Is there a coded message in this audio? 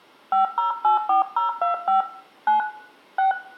Yes: DTMF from 0.3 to 3.3 s, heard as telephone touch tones, dialled by hand, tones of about 130 ms, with room echo. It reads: 5084025 9 6